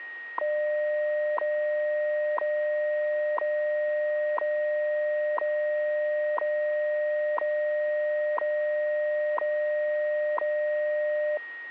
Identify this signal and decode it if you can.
Radio time signal (WWV, Colorado), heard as ticks, one a second, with a steady whistle near 1880 Hz.